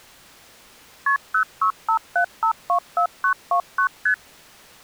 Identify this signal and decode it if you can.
Multi-frequency trunk signalling (R1, as on North American trunks), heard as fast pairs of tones, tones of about 90 ms. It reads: KP 0657524929 ST